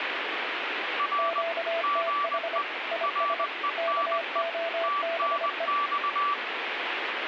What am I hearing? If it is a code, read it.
Morse code, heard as two keyed tones, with radio static. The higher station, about 20 wpm, 1160 Hz: R GE RENE TNX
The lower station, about 25 wpm, 670 Hz: QTH IS KOBE